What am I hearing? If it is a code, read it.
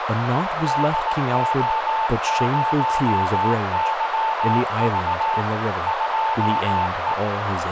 Morse code, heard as a keyed tone, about 18 wpm, 890 Hz, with heavy radio static, a narrow filter and speech in English. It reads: DO0YV 2E